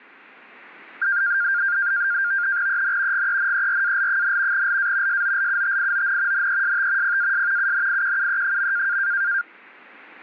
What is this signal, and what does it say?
NAVTEX (SITOR-B), 100 baud, 170 Hz shift, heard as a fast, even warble, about 1500 Hz centre. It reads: EN GENERAL, LA SOLUTION NEST PAS UNIQUE.